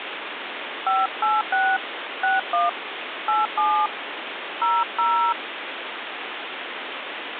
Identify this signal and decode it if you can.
DTMF, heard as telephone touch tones, dialled by hand, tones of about 250 ms, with phone line noise. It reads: 586 61 87 00